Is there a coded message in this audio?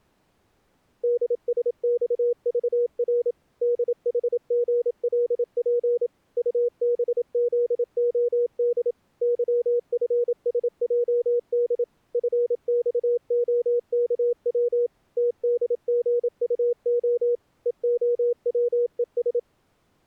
Yes: Morse code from 1.0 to 19.5 s, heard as a keyed tone, machine-sent, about 27 wpm, 480 Hz. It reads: DSXVR DHGLP UBZOD YFSJD FXOKW TDGUO EOWES